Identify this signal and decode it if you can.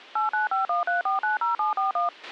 DTMF, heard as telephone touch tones, dialled by machine, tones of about 140 ms, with a squelch burst at the end. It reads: 89513490741